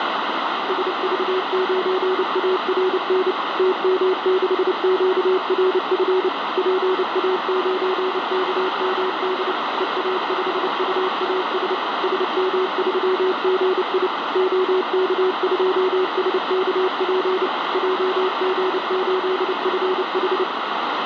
Morse code, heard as a keyed tone, machine-sent, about 29 wpm, 370 Hz, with heavy radio static. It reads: SV9ARN TM6QRF PA9KMD EA5UAS SM3GI OK2SKP JG8FH